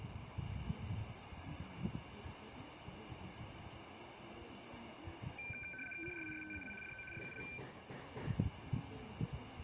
RTTY (75 baud, 850 Hz shift), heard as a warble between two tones, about 1950 Hz centre, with radio static, room echo and the noise of a residential street. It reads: CRISTAL DO SUL